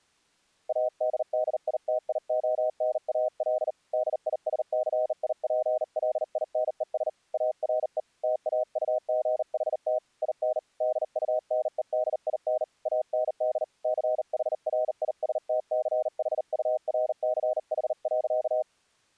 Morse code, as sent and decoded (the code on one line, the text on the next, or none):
.- -.. -.. .. - .. --- -. .- .-.. / -.. .. ... -.-. .. .--. .-.. .. -. . ... / .- .-. . / - .- ..- --. .... - / .. -. / -.. ..- -. . -.. .. -. / .- -. -.. / -.-. .... .-. .. ... - -.-. .... ..- .-. -.-. .... .-.-.-
ADDITIONAL DISCIPLINES ARE TAUGHT IN DUNEDIN AND CHRISTCHURCH.